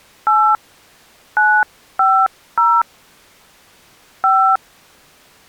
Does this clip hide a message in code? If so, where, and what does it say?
Yes: DTMF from 0.3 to 4.6 s, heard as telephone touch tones, dialled by hand, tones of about 280 ms. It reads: 8 950 5